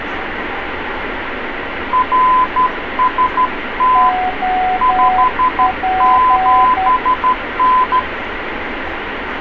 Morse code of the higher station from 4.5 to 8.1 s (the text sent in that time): 57N